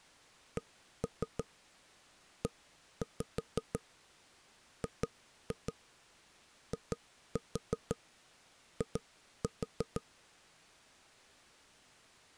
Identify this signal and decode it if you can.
Tap code, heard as knocks on wood, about 6 knocks a second. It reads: CEGII